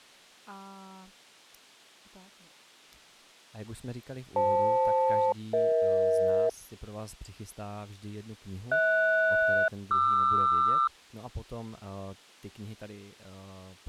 Aircraft SELCAL, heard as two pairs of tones, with speech in Czech. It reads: FL-EH HS-QR